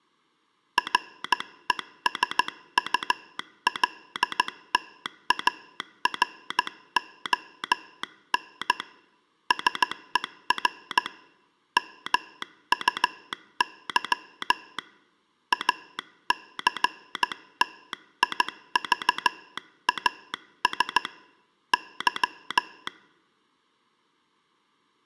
Morse code, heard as a telegraph sounder, hand-sent with a straight key, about 15 wpm. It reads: RESULTARON SER MUY ACTIVAS Y